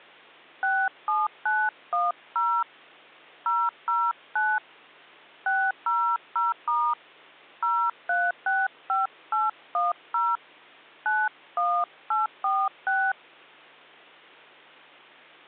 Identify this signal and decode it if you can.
DTMF, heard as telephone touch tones, dialled by hand, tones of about 230 ms. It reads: 67910 009 600* 0365810 91846